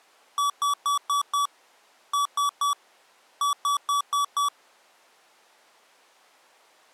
Beep code, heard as beeps from a small speaker, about 1140 Hz. 5-3-5.